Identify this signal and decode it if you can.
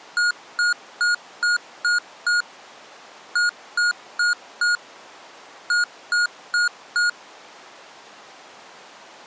Beep code, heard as beeps from a small speaker, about 1440 Hz. 6-4-4.